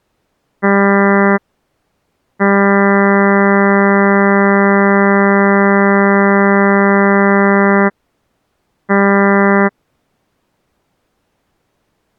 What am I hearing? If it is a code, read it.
Ship horn signal, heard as a ship's horn, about 200 Hz. 1 short, 1 long, 1 short. At sea: a vessel at anchor warns of its position.